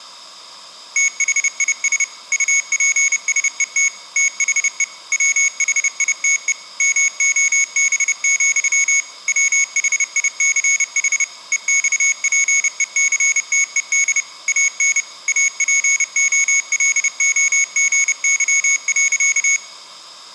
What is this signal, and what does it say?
Morse code, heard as a high beeper, machine-sent, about 30 wpm, 2200 Hz. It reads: THIS UPSET THE WHITE MOB, WHICH EXPECTED AN APOLOGY.